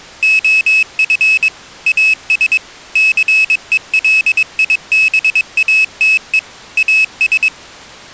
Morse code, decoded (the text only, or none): OF AS CELIBATE AS